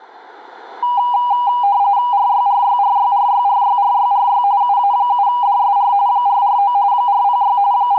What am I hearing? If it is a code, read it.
RTTY (45.45 baud, 170 Hz shift), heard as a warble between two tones, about 890 Hz centre. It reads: RYRYRYRYRYRYRY UA7DSR 449 406 …